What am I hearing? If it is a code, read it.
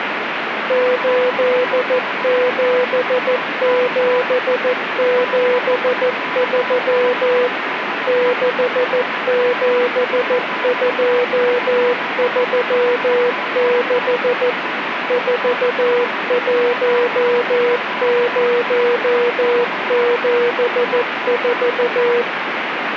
Morse code, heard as a keyed tone, machine-sent, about 14 wpm, 490 Hz, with radio static. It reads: 87773 67236 41074